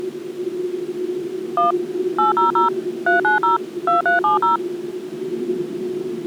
DTMF, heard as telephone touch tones, dialled by machine, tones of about 140 ms, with the noise inside a subway train. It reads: 1 800 390 2370